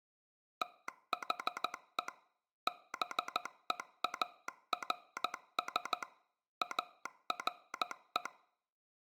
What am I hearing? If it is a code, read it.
Morse code, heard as a telegraph sounder, machine-sent, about 14 wpm. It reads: THE BEARS ARE